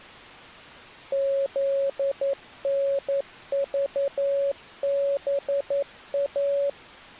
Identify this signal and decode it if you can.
Morse code, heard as a keyed tone, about 11 wpm, 560 Hz. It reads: ZNVBA